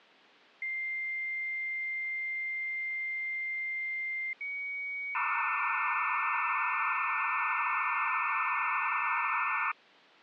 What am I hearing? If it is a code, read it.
Dial-up modem handshake (low-speed, two carriers), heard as two whistles, then hiss.